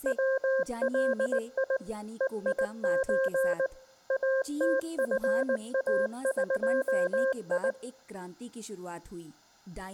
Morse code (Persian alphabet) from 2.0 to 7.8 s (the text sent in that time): هیچ اتفاقی